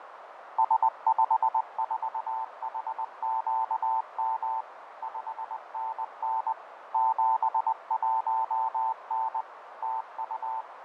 Morse code, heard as a keyed tone, machine-sent, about 20 wpm, 890 Hz, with radio static, fading and a narrow filter. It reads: S54HQM 5NN 71N TU